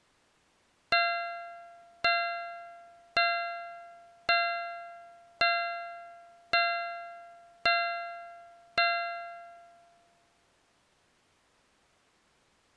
Clock strike, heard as a bell. 8. Eight o'clock.